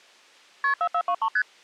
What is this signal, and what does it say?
Multi-frequency trunk signalling (R1, as on North American trunks), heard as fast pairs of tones, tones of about 70 ms. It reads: KP 4423 ST